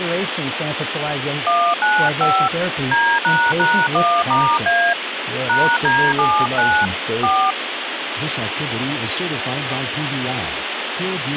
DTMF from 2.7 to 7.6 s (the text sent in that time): D##1*A #D79 4